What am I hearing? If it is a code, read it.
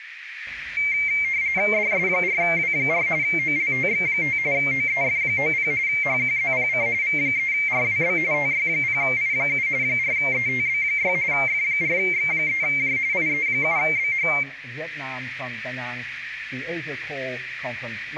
RTTY (45.45 baud, 170 Hz shift), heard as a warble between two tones, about 2200 Hz centre, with radio static. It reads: DS4W4 OLTX5 OEF90 HQZPC V3RWB TY0I7 4ETB6 F4X3J IE7BH